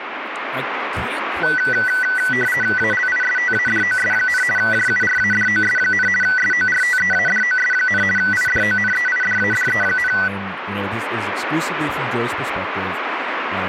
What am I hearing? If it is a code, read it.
RTTY (50 baud, 450 Hz shift), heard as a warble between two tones, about 1750 Hz centre, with radio static and speech in English. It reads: ALISTADOS, JURADOS, SORTEADOS, IDONEIDADE,